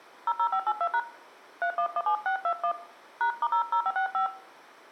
DTMF, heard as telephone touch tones, dialled by hand, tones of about 80 ms, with room echo. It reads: 00582# 3117621 #*00565